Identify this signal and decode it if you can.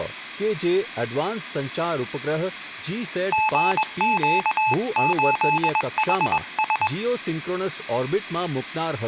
Morse code, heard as a keyed tone, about 21 wpm, 870 Hz, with speech in Gujarati. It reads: GQ8HS